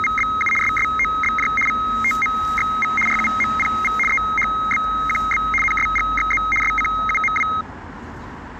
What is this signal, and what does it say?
RTTY (75 baud, 850 Hz shift), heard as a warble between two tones, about 1700 Hz centre, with street noise. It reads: … SSOBJ VTMXV RUMPV EHBQB NSGXZ SCUMW